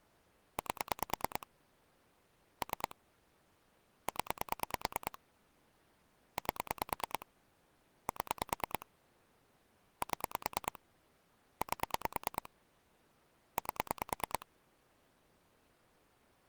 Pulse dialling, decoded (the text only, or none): 8 3 0 8 7 7 8 8